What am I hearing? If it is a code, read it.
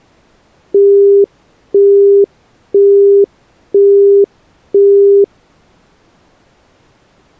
Telephone call progress tone (single-tone plan, as in Europe, Japan and elsewhere), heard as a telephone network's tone, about 400 Hz, 0.5 s on and 0.5 s off. Busy tone.